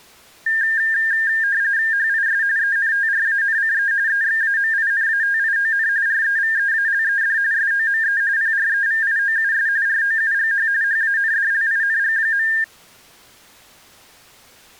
RTTY (45.45 baud, 170 Hz shift), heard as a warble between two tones, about 1700 Hz centre. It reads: HIS ENTRANCE EXAMINATION REVEALED SOME PREVIOUS ROUGH HANDLING.